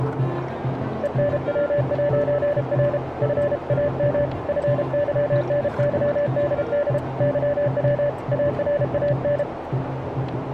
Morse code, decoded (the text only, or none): ENW'R FAM FYNYDD YW ARAN